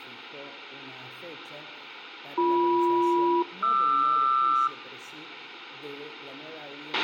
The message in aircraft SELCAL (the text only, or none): BM-QR